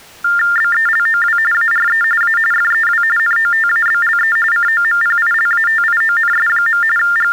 TTY/TDD text telephone tones (45.45 baud Baudot), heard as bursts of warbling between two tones, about 400 Hz shift, 1600 Hz centre. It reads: BELOW ARE A FEW NOTABLE COMPILATIONS. …